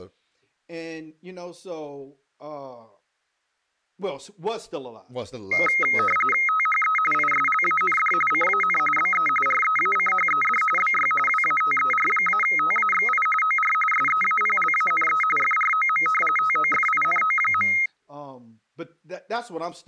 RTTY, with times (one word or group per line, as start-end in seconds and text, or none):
6.5-7.0 THE
7.1-8.1 ISLAND
8.3-8.8 CAN
9.0-9.3 BE
9.5-10.6 REACHED
10.8-11.1 BY
11.3-13.3 WATER-TAXI
13.4-13.7 OR
13.9-15.2 SEAPLANE
15.4-16.1 FROM
16.4-17.7 TOFINO.